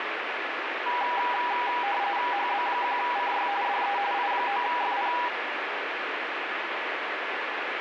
RTTY (45.45 baud, 170 Hz shift), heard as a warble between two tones, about 890 Hz centre, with radio static. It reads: HB1CY DE I9FP